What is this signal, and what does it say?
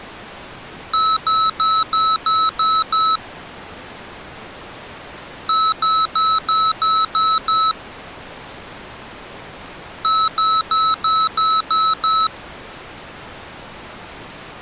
Beep code, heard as beeps from a small speaker, played three times, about 1300 Hz. 7 short. In AMI BIOS tables: virtual mode exception error; in Dell tables: processor failure.